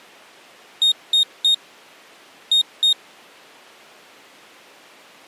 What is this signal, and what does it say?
Beep code, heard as a piezo beeper, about 3700 Hz. 3-2.